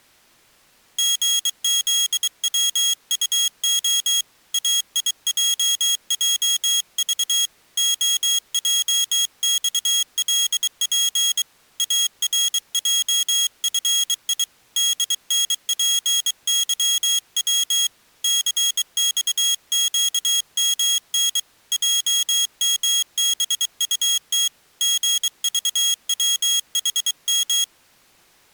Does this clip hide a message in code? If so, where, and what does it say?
Yes: Morse code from 0.9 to 27.7 s, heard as a high beeper, hand-sent with a bug key, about 23 wpm, 3300 Hz. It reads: GZWUO AIJJV OJXLP ARJFI DNPYW CXQMN JMBUT GVWHM